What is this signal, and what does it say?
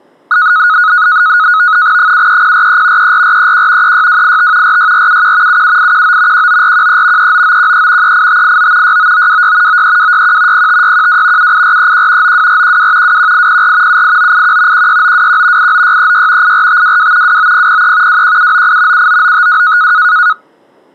NAVTEX (SITOR-B), 100 baud, 170 Hz shift, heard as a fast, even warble, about 1360 Hz centre. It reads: 73043 34431 36285 46471 77819 19413 39913 38589 69926 93261 05612 78431 92412 21804 78981 16921 89636 84522 29003 21798 79952